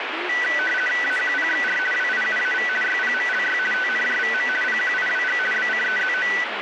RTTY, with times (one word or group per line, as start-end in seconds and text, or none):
1.0-1.8 AQPXR
1.9-2.7 WIUAV
2.8-3.6 YPMLY
3.7-4.5 TNJVM
4.6-5.4 PQIWG
5.5-6.3 BCEZO